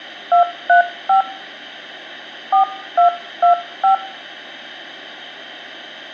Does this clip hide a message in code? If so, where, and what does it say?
Yes: DTMF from 0.3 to 3.9 s, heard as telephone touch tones, dialled by hand, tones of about 120 ms, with hum and room echo. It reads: 235 4225